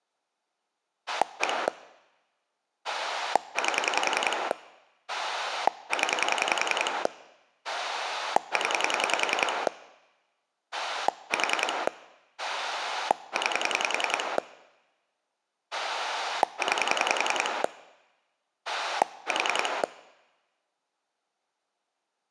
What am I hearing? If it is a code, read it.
Pulse dialling, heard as a rotary dial, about 10 pulses a second. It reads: 1 8 0 0 4 9 9 4